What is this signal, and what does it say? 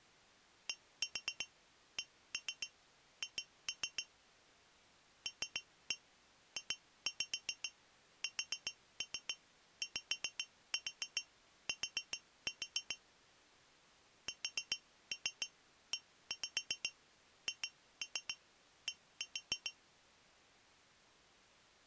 Tap code, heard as taps on glass, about 7 knocks a second. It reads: DCH LJSYT SEHD